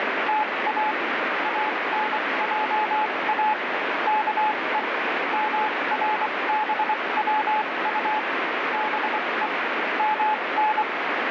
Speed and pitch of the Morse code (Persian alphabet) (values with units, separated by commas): 24 wpm, spaced as for 20 wpm, 860 Hz